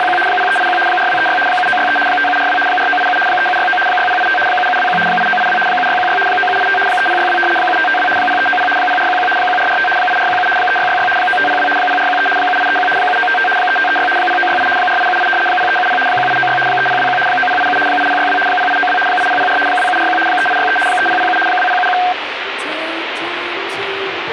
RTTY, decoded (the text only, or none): … 0381 4236 7963 5742 4987 3769 6085 7721 8982 7616 9785 3062 7552 0390 0411 1445 8417 3666 9502 0413 7831 7955 3536 0968 4878 0370 1896 3021 9087 8062 0892 8004 2741 3863 3007 2071